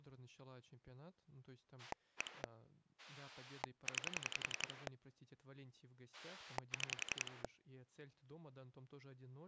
Pulse dialling, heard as a rotary dial, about 11 pulses a second, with speech in Russian. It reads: 1 9 6